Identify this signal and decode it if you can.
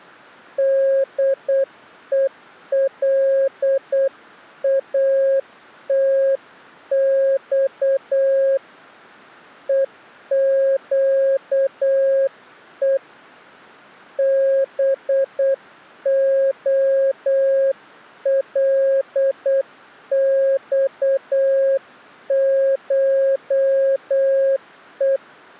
Morse code (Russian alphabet), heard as a keyed tone, hand-sent with a paddle, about 8 wpm, 540 Hz. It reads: ДЕЛАТЬ ЕЩЕ БОЛЬШЕ